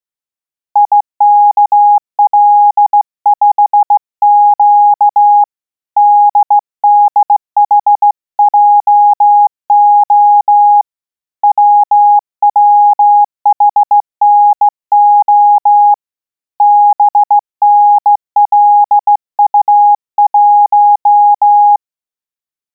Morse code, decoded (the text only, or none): IKL5Q DDHJO WWHNO BNLU1